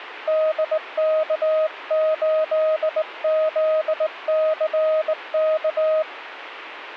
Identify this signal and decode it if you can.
Morse code, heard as a keyed tone, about 19 wpm, 630 Hz. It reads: DK8ZCK